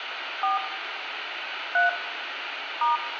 DTMF, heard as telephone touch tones, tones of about 140 ms, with radio hiss and room echo. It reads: 4 3 *